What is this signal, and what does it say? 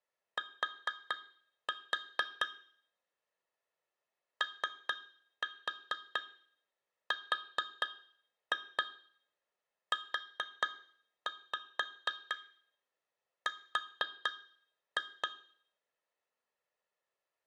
Tap code, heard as taps on glass, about 4 knocks a second, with room echo. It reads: T ORUR